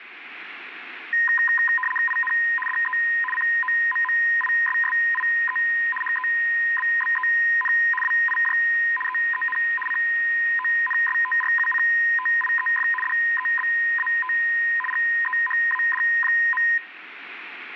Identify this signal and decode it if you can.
RTTY (75 baud, 850 Hz shift), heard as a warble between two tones, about 1440 Hz centre, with radio static. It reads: IN DE COMMISSIE HEBBEN WIJ EEN CONSTRUCTIEF DEBAT GEHAD.